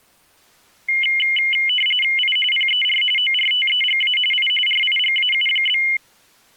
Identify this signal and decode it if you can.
RTTY (45.45 baud, 850 Hz shift), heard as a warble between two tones, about 2550 Hz centre. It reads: I PER ORTEGA I RIGAU?